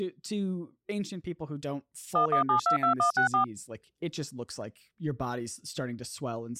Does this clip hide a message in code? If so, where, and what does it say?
Yes: DTMF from 2.2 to 3.4 s, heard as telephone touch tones, dialled by machine, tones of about 110 ms, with speech in English. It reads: 11722164